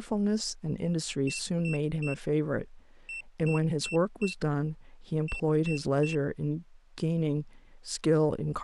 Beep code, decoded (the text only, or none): 3-4-3